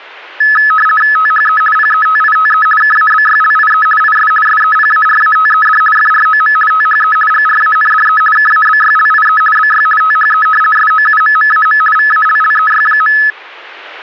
RTTY (50 baud, 450 Hz shift), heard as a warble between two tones, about 1500 Hz centre. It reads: THE PETITE KABYLIE IS SEPARATED FROM THE GRANDE KABYLIE BY THE SOUMMAM VALLEY.